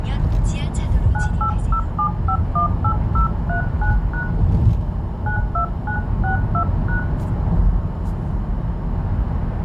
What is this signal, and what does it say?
DTMF, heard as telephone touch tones, dialled by hand, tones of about 100 ms, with room echo and the noise inside a car. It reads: 9807518039# 92962#